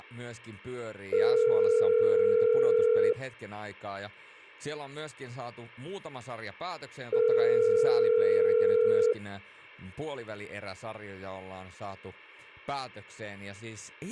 Telephone call progress tone (North American plan), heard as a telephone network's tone, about 440, 480 Hz, 2 s on and 4 s off, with speech in Finnish. Ringback tone.